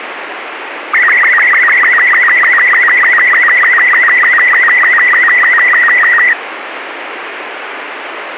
SSTV (slow-scan television), Robot 36, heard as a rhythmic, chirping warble, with radio static.